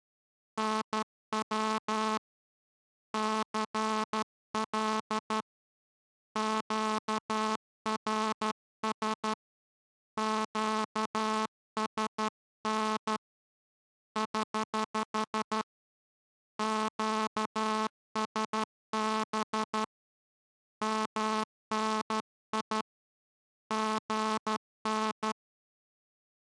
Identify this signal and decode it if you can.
Morse code, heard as a buzzer, hand-sent with a straight key, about 12 wpm. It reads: NW CL QRS QSN <HH> QSB MNI GN